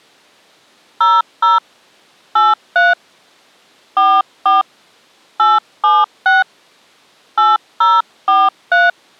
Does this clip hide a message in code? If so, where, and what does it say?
Yes: DTMF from 1.0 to 8.9 s, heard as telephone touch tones, dialled by hand, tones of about 200 ms. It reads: 00 83 44 876 8043